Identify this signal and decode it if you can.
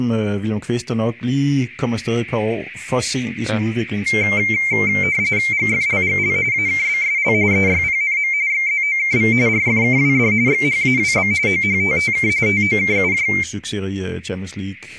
RTTY (45.45 baud, 170 Hz shift), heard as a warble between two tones, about 2200 Hz centre, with speech in Danish. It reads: GFLGL AKBSL EYPNM XZOKV RFKWD XHAWB OHTTK TOKUJ